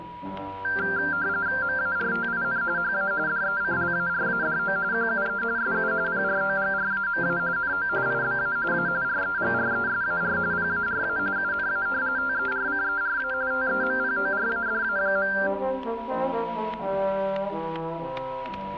RTTY (45.45 baud, 170 Hz shift), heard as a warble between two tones, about 1480 Hz centre, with static crashes and a steady whistle near 970 Hz. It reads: MARTIN HA DECLARADO QUE SU PROGRAMA NO IBA A REGRESAR PARA UNA TERCERA TEMPORADA.